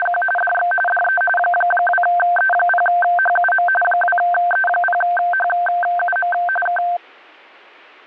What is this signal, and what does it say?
RTTY (45.45 baud, 850 Hz shift), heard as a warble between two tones, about 1130 Hz centre. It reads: … DX DE 2E0HUM 2E0HUM K